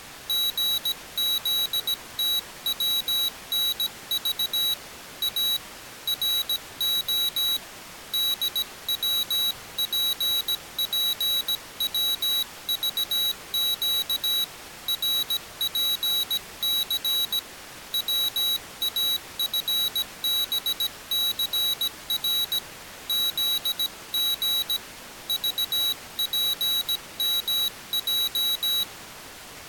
Morse code, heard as a high beeper, hand-sent with a paddle, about 17 wpm, 3900 Hz. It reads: GZTWNV A RO DWPPWVQ RPC WAFBCR ZG VPMJ